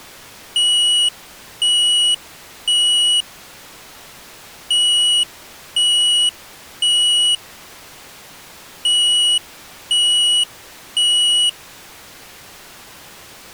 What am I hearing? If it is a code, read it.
Alarm pattern, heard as an alarm's beeps, played three times, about 2900 Hz. Temporal three. Smoke or fire, evacuate.